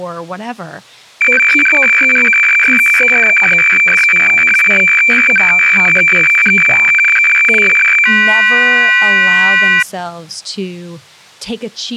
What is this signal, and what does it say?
Weather fax (radiofax), 120 lines a minute, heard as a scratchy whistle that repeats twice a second, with speech in English.